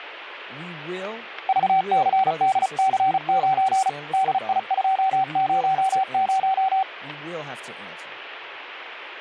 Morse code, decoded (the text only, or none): VCDC9 DI200